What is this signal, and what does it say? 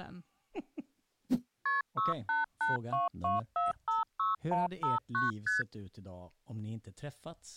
Multi-frequency trunk signalling (R1, as on North American trunks), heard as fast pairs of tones, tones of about 160 ms, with speech in Swedish. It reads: KP 68822456159 ST